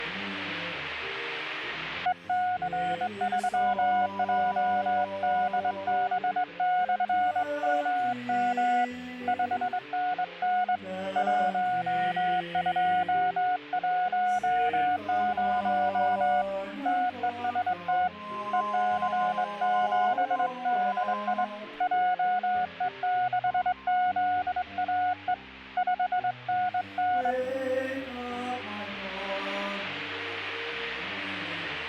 Morse code, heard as a keyed tone, hand-sent with a straight key, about 22 wpm, 730 Hz. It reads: EC3JDB/MM 5NN 1210 TEST EC7DI JE6ZAE 5NN